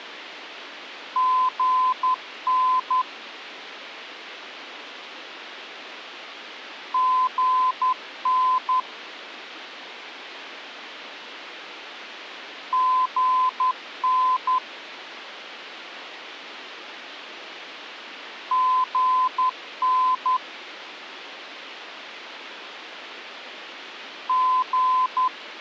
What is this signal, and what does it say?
Morse code, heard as a keyed tone, machine-sent, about 11 wpm, 1020 Hz. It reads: GN GN GN GN …